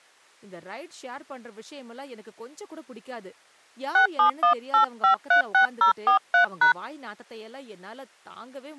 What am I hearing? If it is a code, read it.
DTMF, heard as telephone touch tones, dialled by hand, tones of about 110 ms, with speech in Tamil. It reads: 6718536043#